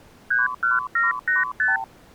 Multi-frequency trunk signalling (R2, with the far end's replies), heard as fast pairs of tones, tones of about 160 ms. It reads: 31785